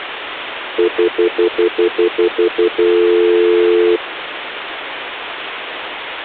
Telephone call progress tone (North American plan), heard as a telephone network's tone, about 350, 440 Hz, 0.1 s on and 0.1 s off, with phone line noise. Stutter dial tone.